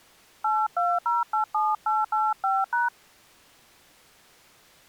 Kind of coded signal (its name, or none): DTMF